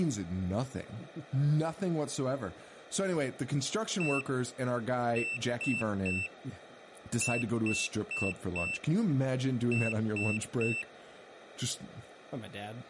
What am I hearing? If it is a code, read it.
Beep code, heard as a piezo beeper, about 2650 Hz, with speech in English. 1-3-4-3. In Phoenix BIOS tables: memory failure on data bits.